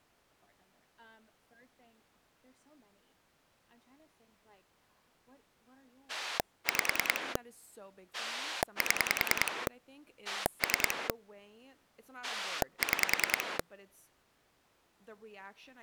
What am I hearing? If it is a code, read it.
Pulse dialling, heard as a rotary dial, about 10 pulses a second, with speech in English. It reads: 5 7 3 6